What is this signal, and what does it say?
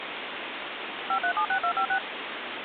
DTMF, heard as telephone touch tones, dialled by machine, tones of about 80 ms, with phone line noise. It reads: 5376256